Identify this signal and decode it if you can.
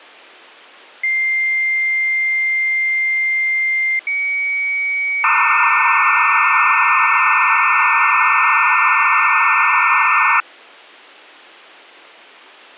Dial-up modem handshake (low-speed, two carriers), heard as two whistles, then hiss.